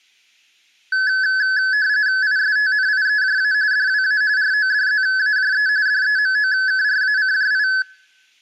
RTTY (45.45 baud, 170 Hz shift), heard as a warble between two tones, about 1600 Hz centre. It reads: ISTNIEJA DWA RODZAJE DEMOKRACJI